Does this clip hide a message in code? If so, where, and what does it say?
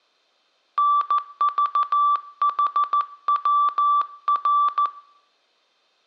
Yes: Morse code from 0.7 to 4.9 s, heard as a keyed tone, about 14 wpm, 1160 Hz, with room echo. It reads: NVHWR